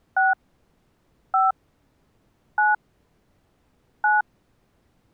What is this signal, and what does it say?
DTMF, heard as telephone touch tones, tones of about 170 ms. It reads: 6 5 9 9